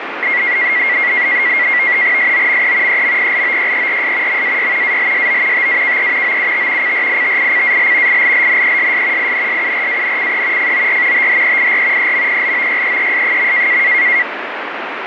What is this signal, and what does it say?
NAVTEX (SITOR-B), 100 baud, 170 Hz shift, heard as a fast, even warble, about 2050 Hz centre, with radio static. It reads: SOME EMPLOYERS MAY ALSO TAKE OUT CRITICAL ILLNESS INSURANCE FOR THEIR EMPLOYEES.